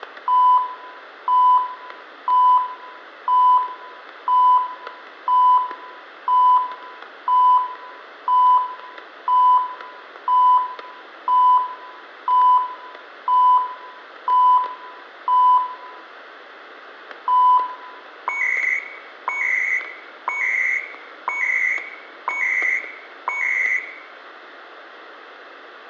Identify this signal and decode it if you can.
Radio time signal (CHU, Canada), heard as beeps and data bursts, one a second, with static crashes and room echo.